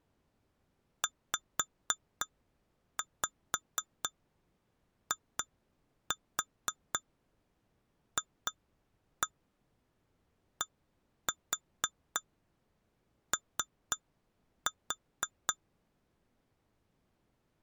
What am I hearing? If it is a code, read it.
Tap code, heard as taps on glass, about 4 knocks a second. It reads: ZIFDO